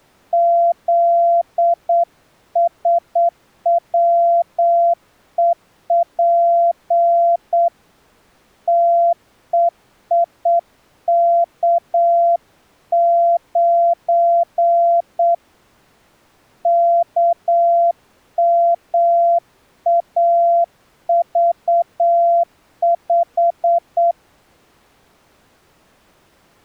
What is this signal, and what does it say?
Morse code, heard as a keyed tone, hand-sent with a straight key, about 8 wpm, 680 Hz. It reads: ZSWEP TEIK9 KMAV5